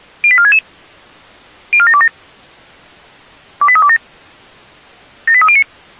Five-tone selective call (ZVEI), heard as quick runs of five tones, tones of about 70 ms. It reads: 08466 04727 28327 78309